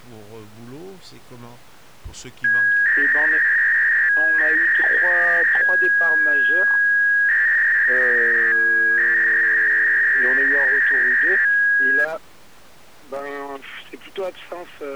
300-baud modem data (V.21 tones), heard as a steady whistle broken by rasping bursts, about 300 baud, 200 Hz shift.